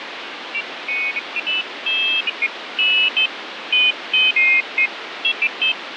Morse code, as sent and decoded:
none

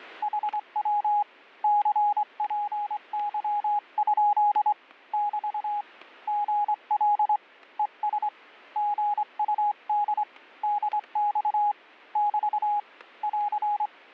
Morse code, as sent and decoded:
.... .-- / -.-. .--. -.-- ..--.. / -...- / --. .-.. / . ... / --. ..- -.. / -.. -..- / -...- / .-.-.
HW CPY? <BT> GL ES GUD DX <BT> <AR>

